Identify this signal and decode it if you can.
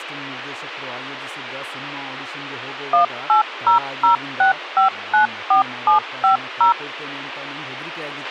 DTMF, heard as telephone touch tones, dialled by machine, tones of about 120 ms, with radio hiss, a squelch burst at the end and speech in Kannada. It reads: 18006594750